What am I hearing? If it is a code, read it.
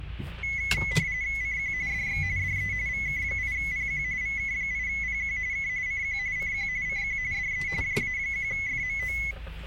RTTY (45.45 baud, 170 Hz shift), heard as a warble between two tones, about 2100 Hz centre, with the noise inside a car. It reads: CQ DX DE VK8PQ VK8PQ K CQ CQ CQ DE JA1FMO